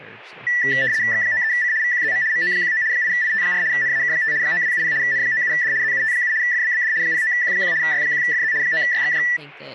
RTTY (75 baud, 170 Hz shift), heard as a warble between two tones, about 1850 Hz centre, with speech in English. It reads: X93C VQZM MO19 8IT4 NAK5 9270 N97D ZUT7 FBBD 09Q1 Y1FZ 9YXJ